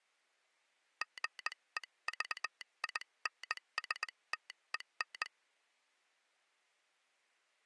Morse code, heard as a telegraph sounder, hand-sent with a straight key, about 19 wpm. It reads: GEVINSTEN